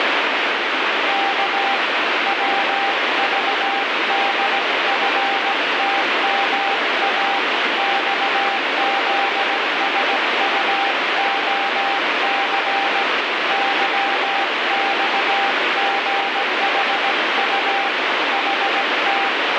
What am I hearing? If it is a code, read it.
Morse code, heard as a keyed tone, hand-sent with a paddle, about 17 wpm, 790 Hz, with heavy radio static. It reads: K WVDFTMA XZSUOC YXGHU HT